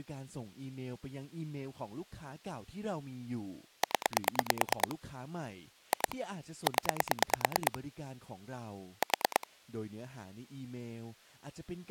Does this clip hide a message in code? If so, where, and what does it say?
Yes: pulse dialling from 3.8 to 9.4 s, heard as clicks on a phone line, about 9 pulses a second, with speech in Thai. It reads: 0 2 0 4